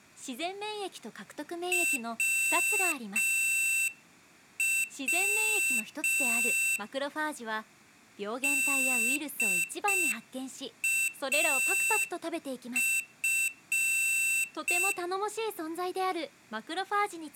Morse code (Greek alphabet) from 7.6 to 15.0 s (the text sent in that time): ΔΑΦ